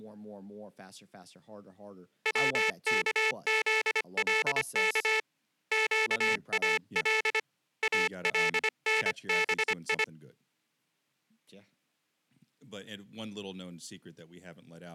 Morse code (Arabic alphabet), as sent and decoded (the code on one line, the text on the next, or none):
.-- -.- --.. .-.. -.- / --.- .- .-.. / .- .-.. -. -... ..
وكذلك قال النبي